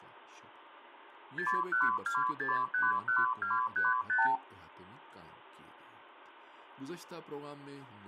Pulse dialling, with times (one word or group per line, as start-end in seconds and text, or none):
none